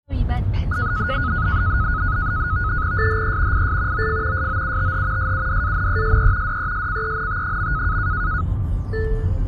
NAVTEX (SITOR-B), 100 baud, 170 Hz shift, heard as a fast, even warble, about 1360 Hz centre, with the noise inside a car. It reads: SHE IS OF SOUTH SUDANESE DESCENT.